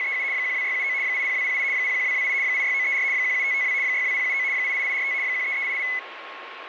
RTTY (75 baud, 170 Hz shift), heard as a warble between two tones, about 2100 Hz centre, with radio static and a steady whistle near 1080 Hz. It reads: … 12679 80208 01228 86934 17552 62079 88845 13388